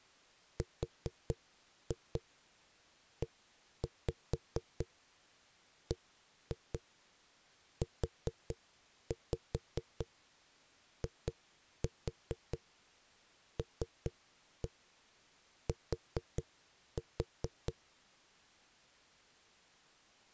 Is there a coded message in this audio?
Yes: tap code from 0.6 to 17.8 s, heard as knocks on a wall, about 4 knocks a second. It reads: REBUILT